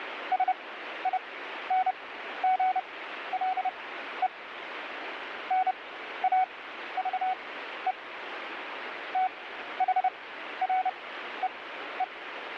Morse code, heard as a keyed tone, machine-sent, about 30 wpm, spaced as for 13 wpm, 750 Hz, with radio static. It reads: SINGLE NAVE THREE